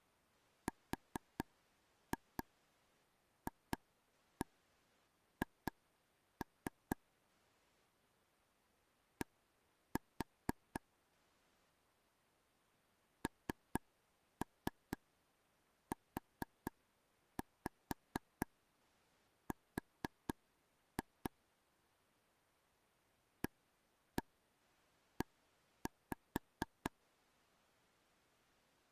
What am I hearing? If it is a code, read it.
Tap code, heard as taps on a table, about 4 knocks a second. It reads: RFH D NUR AE